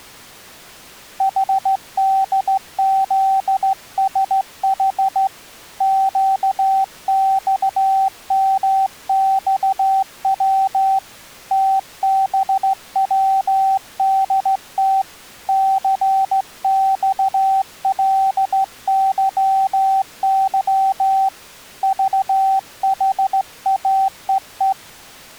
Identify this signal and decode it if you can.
Morse code, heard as a keyed tone, hand-sent with a straight key, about 15 wpm, 770 Hz. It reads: HDZSH QXMXW TBWDT CXLYY VHAEE